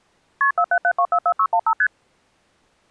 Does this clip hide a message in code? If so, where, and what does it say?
Yes: multi-frequency trunk signalling (R1, as on North American trunks) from 0.4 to 1.9 s, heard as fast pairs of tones, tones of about 70 ms. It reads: KP 477244615 ST